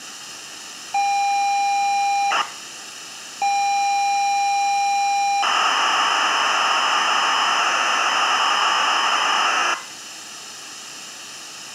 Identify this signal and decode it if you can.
ZX Spectrum tape loading, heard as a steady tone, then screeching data, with room echo.